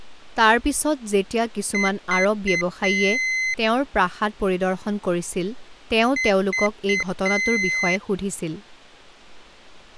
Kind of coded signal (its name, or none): beep code